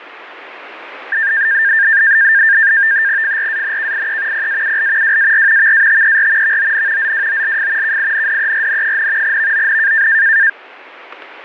NAVTEX (SITOR-B), 100 baud, 170 Hz shift, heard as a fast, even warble, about 1700 Hz centre, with radio static. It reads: FRANKIE PAUL WAR VATER VON ZWOLF KINDERN, VON